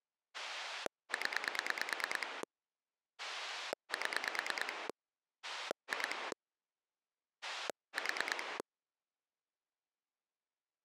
Pulse dialling, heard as a rotary dial, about 9 pulses a second. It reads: 0 7 2 4